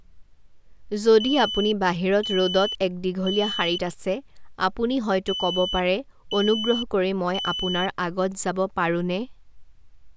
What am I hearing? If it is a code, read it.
Alarm pattern, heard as an alarm's beeps, played twice, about 3000 Hz, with speech in Assamese. Temporal three. Smoke or fire, evacuate.